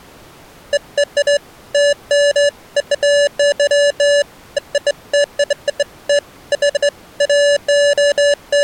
Beeps of irregular length. There is no code.